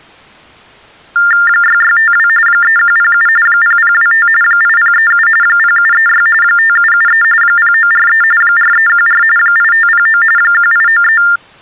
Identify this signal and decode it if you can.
TTY/TDD text telephone tones (45.45 baud Baudot), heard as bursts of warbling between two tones, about 400 Hz shift, 1600 Hz centre. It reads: 6652 3107 0025 8037 0736 5773 0943 4314 8509 1893